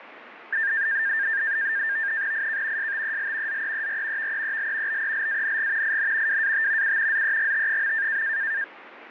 NAVTEX (SITOR-B), 100 baud, 170 Hz shift, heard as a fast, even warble, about 1700 Hz centre, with radio static. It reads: IK STEL ZEER VEEL BELANG IN WAT U ZEGT.